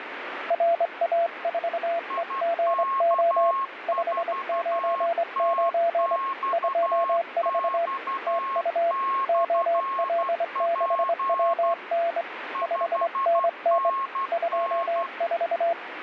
Morse code, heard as two keyed tones, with radio static. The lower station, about 24 wpm, 680 Hz: RA4EGO 599 24 TU OL6WN 5NN 24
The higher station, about 12 wpm, 1080 Hz: IK4TXX/P 5NN